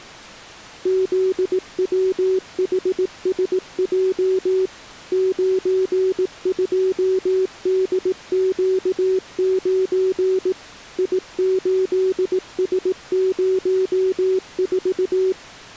Morse code, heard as a keyed tone, machine-sent, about 18 wpm, 380 Hz. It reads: ZWHSJ 92DQ9 I8S04